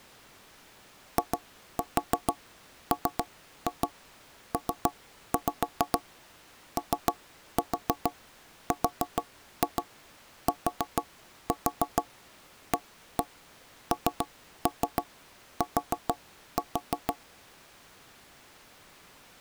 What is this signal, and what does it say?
Tap code, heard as knocks on wood, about 6 knocks a second. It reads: IMPORTANT